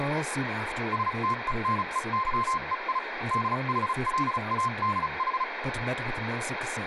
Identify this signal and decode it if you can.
Morse code (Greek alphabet), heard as a keyed tone, machine-sent, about 35 wpm, spaced as for 31 wpm, 1050 Hz, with radio static and speech in English. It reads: ΣΤΕΝΕΥΕΙ ΔΗΛΑΔΗ